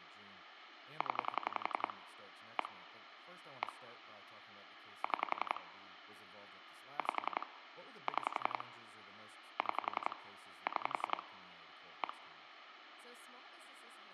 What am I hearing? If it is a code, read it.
Pulse dialling, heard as clicks on a phone line, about 11 pulses a second, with phone line noise and speech in English. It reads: 0 1 1 6 5 6 6 6 1